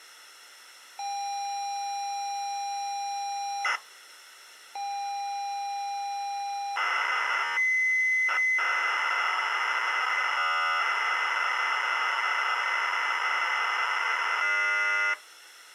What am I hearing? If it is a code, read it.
ZX Spectrum tape loading, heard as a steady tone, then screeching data.